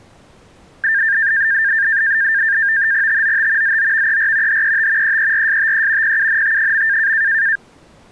NAVTEX (SITOR-B), 100 baud, 170 Hz shift, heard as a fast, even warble, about 1700 Hz centre. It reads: TOT ZOVER HET EERSTE PUNT.